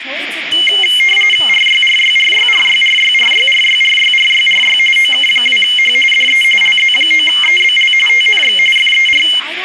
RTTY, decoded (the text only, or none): RYRYRYRYRYRYRYRYRYRY OK2H DE LZ9EBL TNX FER